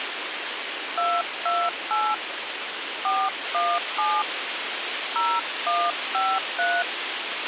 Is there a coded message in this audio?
Yes: DTMF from 1.0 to 6.8 s, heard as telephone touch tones, dialled by hand, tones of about 240 ms, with radio hiss and a squelch burst at the end. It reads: 228 417 0153